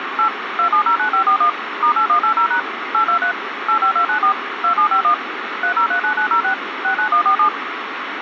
DTMF, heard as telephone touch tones, dialled by machine, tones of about 100 ms, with phone line noise. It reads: 8 2709541 *8180# 823 85294 2751 3039906 69147